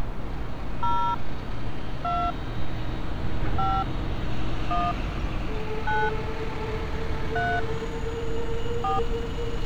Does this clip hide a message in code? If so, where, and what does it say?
Yes: DTMF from 0.8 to 9.0 s, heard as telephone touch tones, dialled by hand, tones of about 240 ms, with street noise. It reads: 0 2 5 1 9 3 4